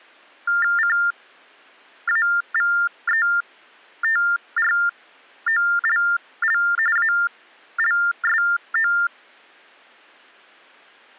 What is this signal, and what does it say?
TTY/TDD text telephone tones (45.45 baud Baudot), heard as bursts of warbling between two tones, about 400 Hz shift, 1600 Hz centre. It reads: CAVETROLL ALSO